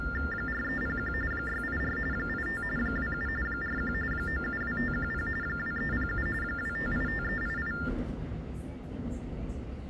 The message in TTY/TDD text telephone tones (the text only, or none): 4301 684 85 27 41 972510 2307 2585388